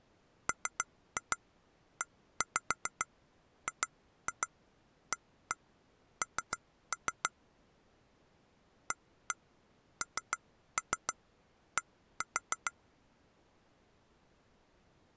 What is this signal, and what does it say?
Tap code, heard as taps on glass, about 6 knocks a second. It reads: MEGAN AND